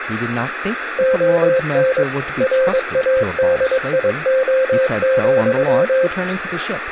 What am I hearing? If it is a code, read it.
Morse code, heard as a keyed tone, machine-sent, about 22 wpm, 520 Hz, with radio static, room echo and speech in English. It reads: ON RADIO,